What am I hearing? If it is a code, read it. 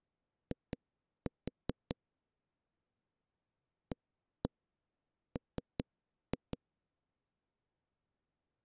Tap code, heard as knocks on a wall, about 5 knocks a second. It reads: I AM